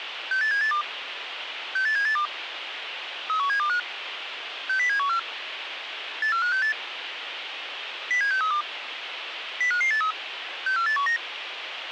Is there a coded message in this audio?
Yes: five-tone selective call (CCIR) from 0.3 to 11.2 s, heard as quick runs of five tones, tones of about 100 ms, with radio hiss. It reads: 68782 68782 31725 60714 84568 07632 05583 64819